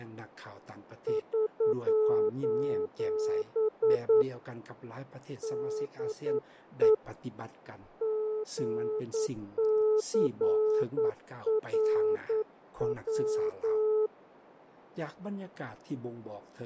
Morse code, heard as a keyed tone, hand-sent with a paddle, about 9 wpm, 430 Hz, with radio static and fading. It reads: <SOS> DE GCRW